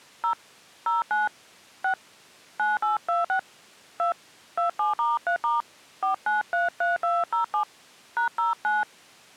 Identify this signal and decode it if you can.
DTMF, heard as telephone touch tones, dialled by hand, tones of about 150 ms. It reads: 0 09 6 9826 2 27*3* 4933207 #09